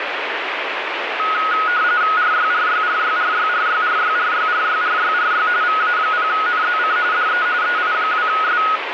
RTTY (45.45 baud, 170 Hz shift), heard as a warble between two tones, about 1360 Hz centre, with radio static. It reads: RYRYRYRYRYRYRYRYRYRY VA0NZC DE EI2S